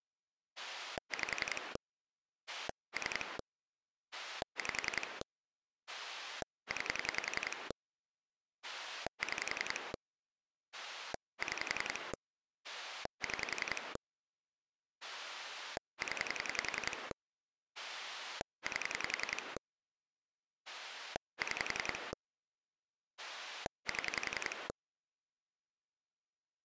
Pulse dialling, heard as a rotary dial, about 10 pulses a second. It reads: 5 3 5 9 6 6 6 0 8 6 7